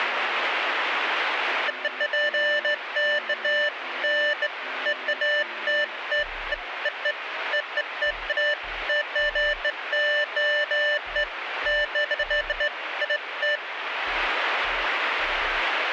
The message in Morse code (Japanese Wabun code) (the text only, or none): none